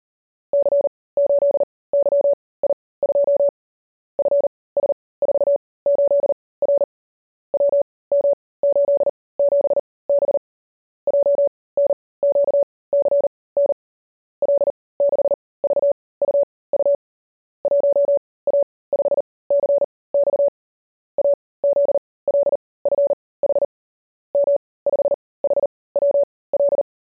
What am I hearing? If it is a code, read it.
Morse code, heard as a keyed tone, machine-sent, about 39 wpm, spaced as for 21 wpm, 570 Hz. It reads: C8YI2 FS48R WM87B JNQCN L6VUU 1A5CX AZLFH M5HWL